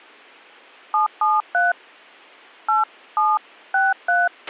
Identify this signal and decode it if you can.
DTMF, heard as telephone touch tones, dialled by hand, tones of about 180 ms, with a squelch burst at the end. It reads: 773 8763